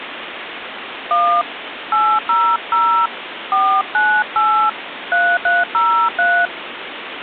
DTMF, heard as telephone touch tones, dialled by hand, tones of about 250 ms, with phone line noise. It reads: 1 800 498 3303